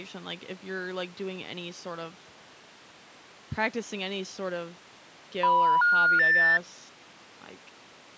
Telephone call progress tone (North American plan), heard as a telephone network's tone, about 980, 1430, 1800 Hz, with speech in English. Special information tone.